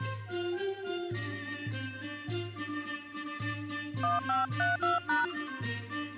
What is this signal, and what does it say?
DTMF, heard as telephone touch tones, dialled by hand, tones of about 160 ms. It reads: 1532#